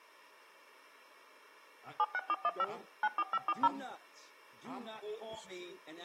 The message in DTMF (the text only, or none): 76415 94540